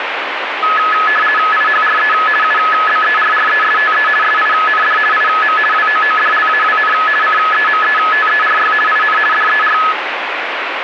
RTTY (50 baud, 450 Hz shift), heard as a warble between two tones, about 1490 Hz centre, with radio static. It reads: IHRE UBERRESTE SIND IM WOODLAWN CEMETERY IN DER